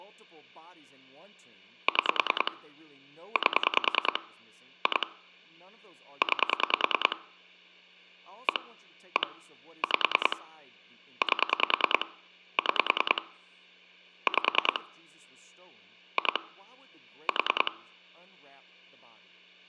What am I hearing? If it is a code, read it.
Pulse dialling, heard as clicks on a phone line, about 10 pulses a second, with hum and speech in English. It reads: 6 8 2 9 1 1 5 8 6 5 2 4